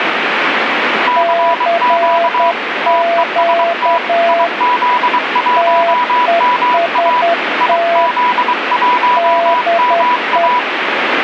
Morse code, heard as two keyed tones, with radio static. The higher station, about 23 wpm, 980 Hz: CQ TEST IZ1MA IZ1MA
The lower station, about 10 wpm, 680 Hz: CQ TEST DE